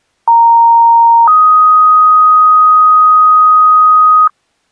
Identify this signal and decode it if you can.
Two-tone page, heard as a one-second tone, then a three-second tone, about 930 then 1250 Hz.